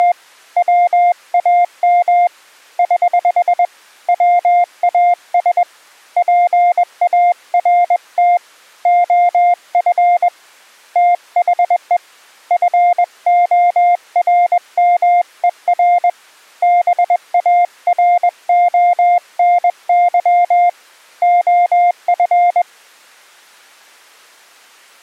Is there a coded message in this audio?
Yes: Morse code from 0.0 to 22.7 s, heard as a keyed tone, hand-sent with a paddle, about 21 wpm, 700 Hz. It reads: … WAM <HH> WAS PART OF THE FORMER BARONY OF